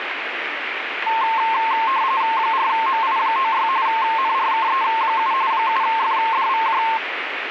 RTTY (45.45 baud, 170 Hz shift), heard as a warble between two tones, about 980 Hz centre, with radio static. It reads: 4MI96 NRKE7 7FDVJ